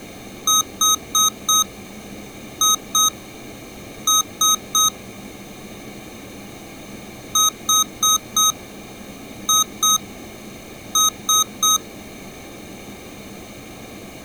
Beep code, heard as beeps from a small speaker, played twice, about 1260 Hz. 4-2-3. In Phoenix BIOS tables: gate A20 failure.